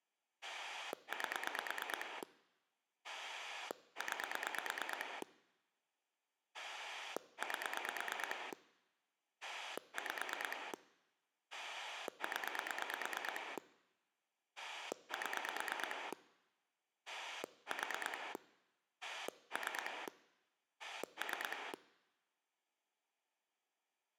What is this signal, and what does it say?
Pulse dialling, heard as a rotary dial, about 9 pulses a second. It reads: 8 9 8 5 0 7 4 3 3